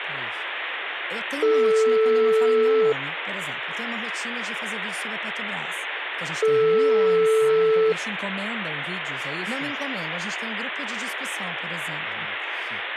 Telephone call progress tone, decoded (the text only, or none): ringback tone